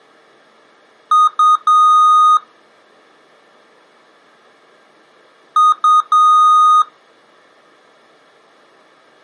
Beep code, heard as beeps from a small speaker, played twice, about 1240 Hz. 2 short, 1 long.